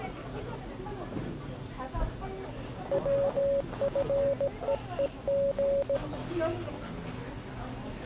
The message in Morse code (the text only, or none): WFEEG